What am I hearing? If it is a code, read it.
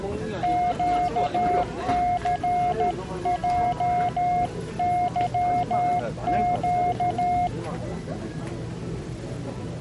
Morse code, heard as a keyed tone, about 13 wpm, 710 Hz, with the noise of a crowd indoors. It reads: QCJYQ